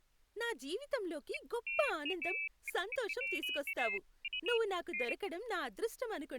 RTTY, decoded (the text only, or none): none